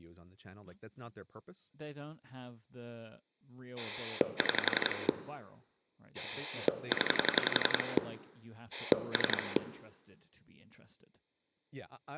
Pulse dialling, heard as a rotary dial, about 11 pulses a second, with room echo and speech in English. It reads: 6 0 3